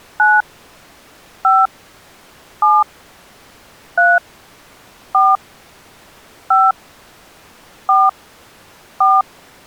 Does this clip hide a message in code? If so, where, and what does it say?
Yes: DTMF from 0.2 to 9.2 s, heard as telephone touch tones, dialled by hand, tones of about 210 ms. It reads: 9 5 7 3 4 5 4 4